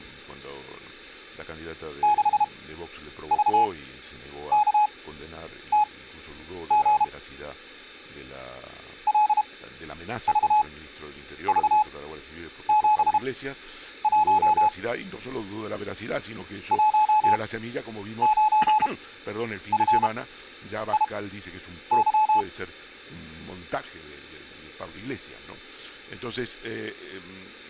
Morse code, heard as a keyed tone, machine-sent, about 32 wpm, spaced as for 9 wpm, 850 Hz. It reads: 6VKTG LVV71 19FIY